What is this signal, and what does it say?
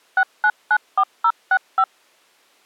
DTMF, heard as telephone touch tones, dialled by machine, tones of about 60 ms. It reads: 6994065